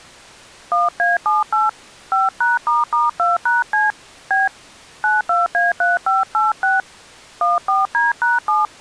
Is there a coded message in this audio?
Yes: DTMF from 0.7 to 8.7 s, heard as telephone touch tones, dialled by hand, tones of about 170 ms. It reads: 1A78 5#**2#C B 92A3586 14D#7